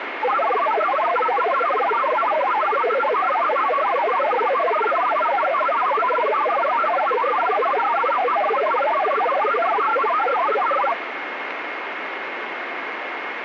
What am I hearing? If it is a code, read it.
Multi-tone FSK (Olivia or MFSK type), about 1000 Hz wide, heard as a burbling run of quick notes, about 62.5 baud, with radio static.